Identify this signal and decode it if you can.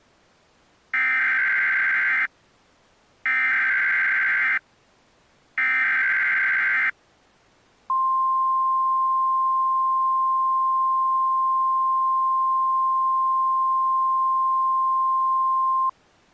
Emergency Alert System (SAME) tones (header bursts, then the 1050 Hz attention tone), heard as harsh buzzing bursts, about 520.83 baud.